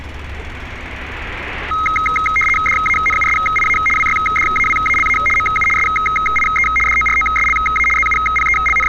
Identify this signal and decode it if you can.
RTTY (75 baud, 850 Hz shift), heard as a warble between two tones, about 1700 Hz centre, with street noise. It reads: DANUSIA WYDAWALA MU SIE DOROSLA …